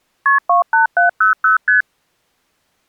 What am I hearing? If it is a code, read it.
Multi-frequency trunk signalling (R1, as on North American trunks), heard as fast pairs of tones, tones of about 130 ms. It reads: KP 28700 ST